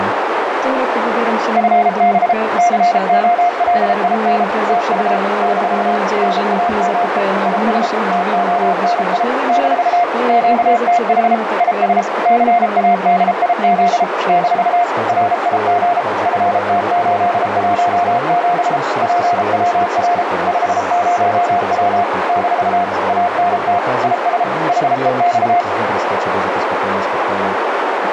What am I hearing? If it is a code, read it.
Morse code, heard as a keyed tone, machine-sent, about 33 wpm, 700 Hz, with heavy radio static and a narrow filter. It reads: FB COLIN TU - NAME IS TONI - QTH IS CADIZ - RIG FT817 PWR 50W - ANT IS HEX